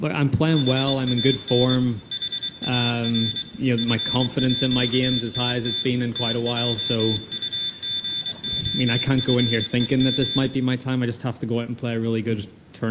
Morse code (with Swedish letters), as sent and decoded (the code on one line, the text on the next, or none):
.... .- -. / .... .- .-. / ..-. .--.- - - / - .--- ..- --. --- ..-. . --
HAN HAR FÅTT TJUGOFEM